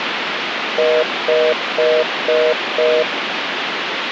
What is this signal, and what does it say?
Telephone call progress tone (North American plan), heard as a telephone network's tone, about 480, 620 Hz, 0.25 s on and 0.25 s off, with phone line noise. Congestion tone.